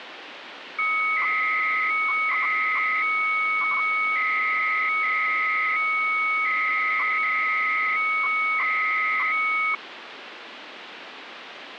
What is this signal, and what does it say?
300-baud modem data (Bell 103 tones), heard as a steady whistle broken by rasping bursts, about 300 baud, 200 Hz shift, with phone line noise.